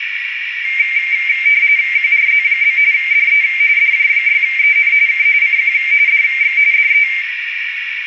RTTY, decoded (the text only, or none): QRZ? DE DJ6EN K CQ DX DE